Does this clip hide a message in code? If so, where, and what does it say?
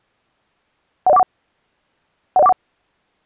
Yes: five-tone selective call (EIA) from 1.1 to 2.5 s, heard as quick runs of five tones, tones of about 30 ms. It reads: 10141 10141